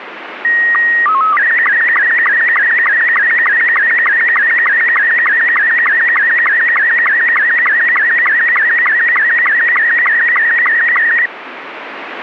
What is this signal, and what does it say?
SSTV (slow-scan television), Robot 72, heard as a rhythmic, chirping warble, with radio static.